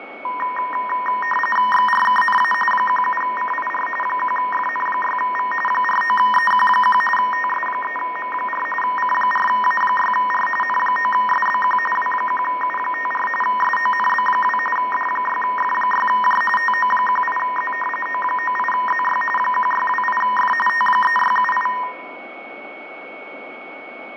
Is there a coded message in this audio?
Yes: RTTY (45.45 baud, 850 Hz shift) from 0.2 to 21.8 s, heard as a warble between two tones, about 1420 Hz centre, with radio static, fading, a steady whistle near 2220 Hz and room echo. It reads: XRKNA 17CIR 1FN6V 49EQ1 TS3M4 C4A6R N9SBQ W1U54 SONB2 D6F6J TO18Z O98ZY 1628F T3678